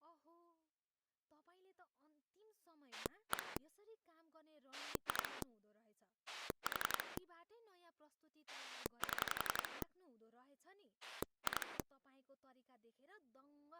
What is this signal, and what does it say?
Pulse dialling, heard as a rotary dial, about 11 pulses a second, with speech in Nepali. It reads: 1 2 4 7 2